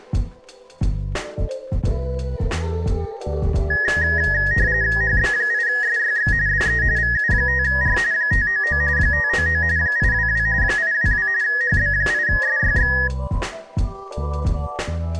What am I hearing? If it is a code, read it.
RTTY (45.45 baud, 170 Hz shift), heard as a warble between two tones, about 1800 Hz centre. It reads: HB8SYX DE VU5R 599 599 822 822 HB8SYX